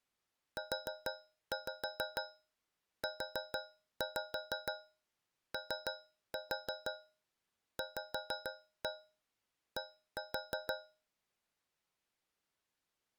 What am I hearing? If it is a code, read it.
Tap code, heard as taps on a metal pipe, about 6 knocks a second. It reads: UUOVD